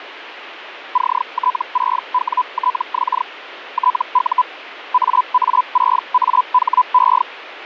Hellschreiber (Feld-Hell, 122.5 baud), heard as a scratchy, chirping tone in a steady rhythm, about 1000 Hz, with radio static. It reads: CT6WTX TU AA6AHE